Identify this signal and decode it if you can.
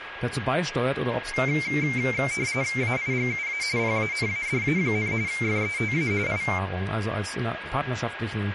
RTTY (45.45 baud, 170 Hz shift), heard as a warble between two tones, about 2200 Hz centre, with radio static, a steady whistle near 1640 Hz and speech in German. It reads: AIGUA PANADA, FETA I